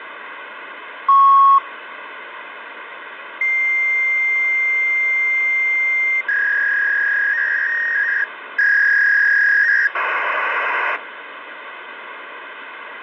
Fax machine handshake, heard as a beep, a long tone, a warble and hiss, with phone line noise.